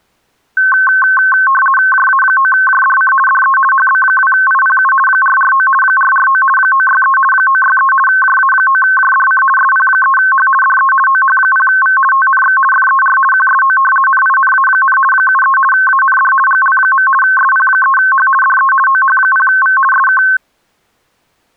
RTTY (50 baud, 450 Hz shift), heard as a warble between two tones, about 1300 Hz centre. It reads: JA9JDC DE HB2IPU 449 449 963 963 JA9JDC SP3H DE OH0V TNX FER QSO NINA, 73 AND GL. SP3H DE OH0V SK